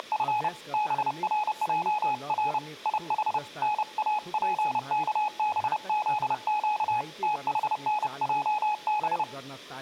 Morse code, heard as a keyed tone, hand-sent with a paddle, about 30 wpm, 840 Hz, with room echo and speech in Nepali. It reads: … BRJR IH NAPKBZQ THNJB